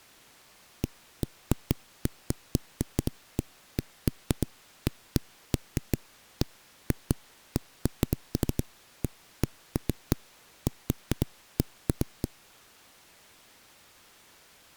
Irregular knocks on a wall. There is no code.